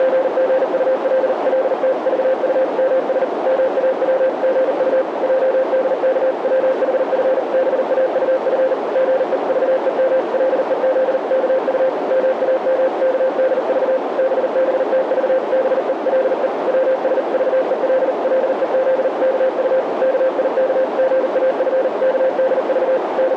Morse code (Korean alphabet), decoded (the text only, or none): … 몹시 흥분된 사람같이 몸을 떨다가 벼락같이 양손을 …